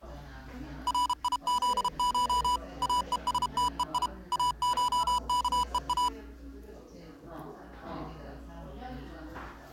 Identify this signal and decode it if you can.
Morse code (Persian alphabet), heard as electronic beeps, machine-sent, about 32 wpm, 990 Hz, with the noise of a crowd indoors. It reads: ریزش اهستهی اشکها